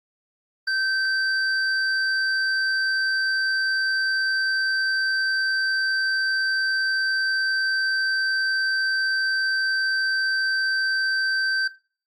A steady tone, with room echo. There is no code.